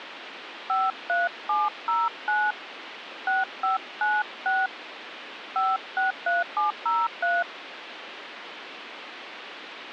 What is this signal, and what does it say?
DTMF, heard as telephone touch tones, dialled by hand, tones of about 200 ms, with phone line noise. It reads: 53709 6596 563703